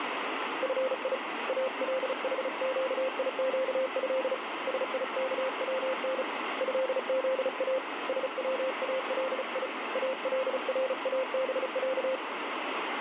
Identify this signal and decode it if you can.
Morse code (Arabic alphabet), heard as a keyed tone, hand-sent with a paddle, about 35 wpm, 520 Hz, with radio static. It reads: في الحقيقه سيكون هذا سوالي الرابع